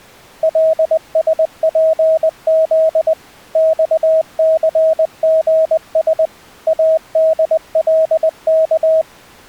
Morse code, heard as a keyed tone, machine-sent, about 20 wpm, 640 Hz. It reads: LSPZ XCGS ADLK